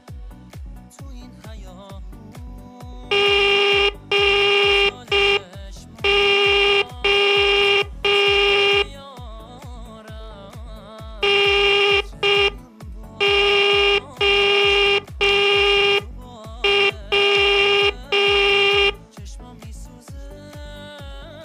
Morse code, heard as a buzzer, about 5 wpm. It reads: GO NOW